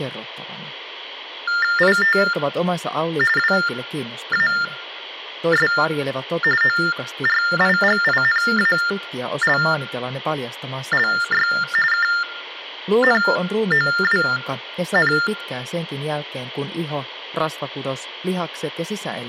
TTY/TDD text telephone tones (45.45 baud Baudot), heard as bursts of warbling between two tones, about 400 Hz shift, 1600 Hz centre, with room echo. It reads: IT WAS ORIGINALLY KNOWN